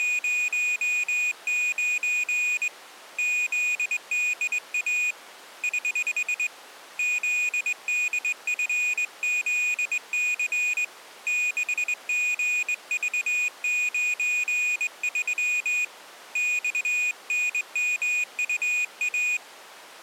Morse code, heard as a high beeper, hand-sent with a straight key, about 21 wpm, 2450 Hz. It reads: … ZDA <HH> ZDFZC 6GV93 XNMUA